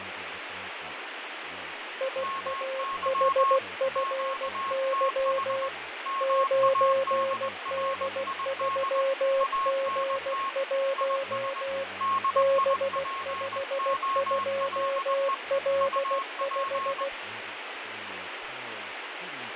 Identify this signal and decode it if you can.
Morse code, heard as two keyed tones, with radio static, fading and speech in English. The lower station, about 16 wpm, 540 Hz: IAHFY 9D3G1 B52L5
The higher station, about 20 wpm, 1090 Hz: MY QTH MADRID ANT IS DIPOLE UP